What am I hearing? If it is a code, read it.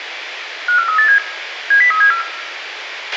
Five-tone selective call (CCIR), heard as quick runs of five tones, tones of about 100 ms, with radio hiss, a squelch burst at the end and room echo. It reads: 54387 70374